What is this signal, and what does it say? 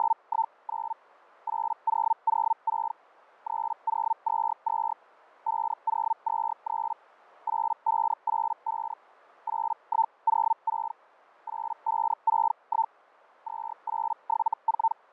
Hellschreiber (Feld-Hell, 122.5 baud), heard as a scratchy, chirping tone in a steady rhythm, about 900 Hz. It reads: … 8006 3022 5023 8585 8106 8561 2874